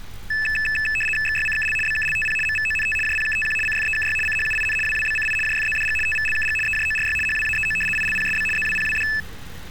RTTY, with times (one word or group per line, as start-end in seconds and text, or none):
1.3-1.8 XYCKL
1.9-2.4 BKLTP
2.5-3.0 MVONT
3.1-3.6 JPKTQ
3.7-4.2 CFEKY
4.3-4.8 CHUIN
4.9-5.4 WWBCI
5.5-6.0 JFZDG
6.1-6.6 TVLKG
6.7-7.2 EJORY
7.3-7.8 HWAEO
8.0-8.5 ILPSB
8.6-9.1 ZWPWD